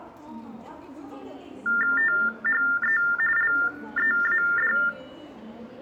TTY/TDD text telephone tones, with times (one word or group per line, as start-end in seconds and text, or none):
2.0-3.0 THE
3.4-4.7 LEAD